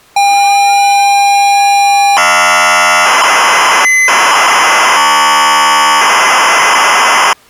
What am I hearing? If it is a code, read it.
ZX Spectrum tape loading, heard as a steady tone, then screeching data.